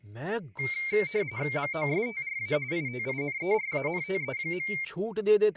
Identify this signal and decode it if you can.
RTTY (45.45 baud, 170 Hz shift), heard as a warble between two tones, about 2200 Hz centre, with speech in Hindi. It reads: MOSTRA ITINERANTE.